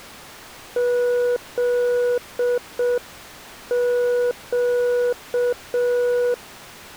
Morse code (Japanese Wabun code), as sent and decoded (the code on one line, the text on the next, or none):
--.. --.-
フネ